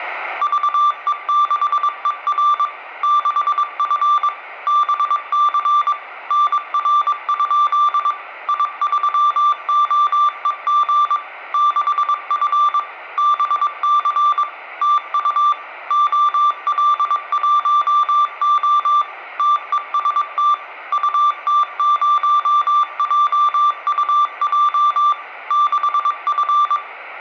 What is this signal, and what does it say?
Morse code, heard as a keyed tone, machine-sent, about 22 wpm, 1180 Hz, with room echo. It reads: VE6ER 6F BC NR? I3OEG 6F BC TU OL1O TEST UT0JUJ 6F